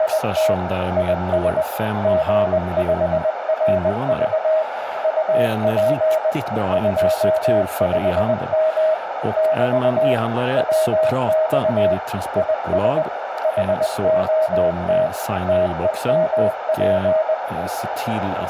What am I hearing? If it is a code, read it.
Morse code, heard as a keyed tone, machine-sent, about 20 wpm, 630 Hz, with radio static, a narrow filter, room echo and speech in Swedish. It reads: … IS G5RV UP 25M <BT> WX IS HOT TEMP